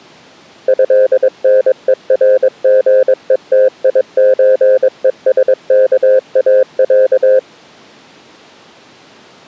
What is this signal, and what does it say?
Morse code (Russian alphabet), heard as a keyed tone, machine-sent, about 22 wpm, 520 Hz. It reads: ЭНЕРГЕТИЧЕСКАЯ